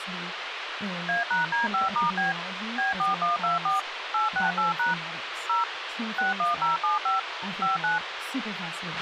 DTMF, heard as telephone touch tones, dialled by machine, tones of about 150 ms, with radio hiss, a squelch burst at the end and speech in English. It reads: A#D5*B B4124 868# 0 61075 59